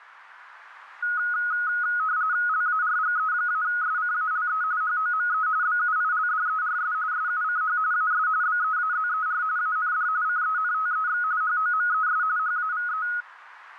RTTY (45.45 baud, 170 Hz shift), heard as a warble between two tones, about 1360 Hz centre, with radio static. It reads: LARGE-SCALE HOME BUILDERS SUCH AS BEAZER AND CENTEX HOMES HAVE